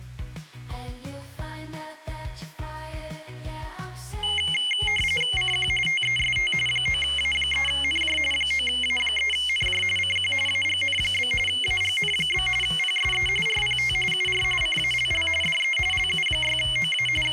RTTY (45.45 baud, 850 Hz shift), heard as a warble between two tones, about 2550 Hz centre. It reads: CQ TEST 9A3NJ 9A3NJ CQ AGN? AGN? PSE RPT UR CALL DE LU6OA …